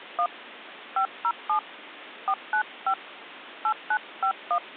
DTMF, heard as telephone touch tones, dialled by hand, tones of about 80 ms. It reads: 1 507 495 8951